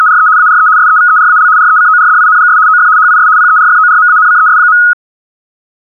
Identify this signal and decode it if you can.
RTTY (75 baud, 170 Hz shift), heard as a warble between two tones, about 1360 Hz centre. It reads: … ARE SEVERAL RECORDINGS OF HIS PERFORMANCES.